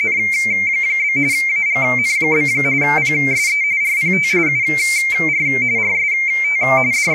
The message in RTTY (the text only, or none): … AGN? PSE RPT UR RST …